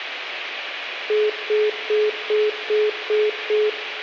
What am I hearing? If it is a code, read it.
Telephone call progress tone (single-tone plan, as in most of Europe), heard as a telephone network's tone, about 420 Hz, 0.2 s on and 0.2 s off, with phone line noise and room echo. Congestion tone.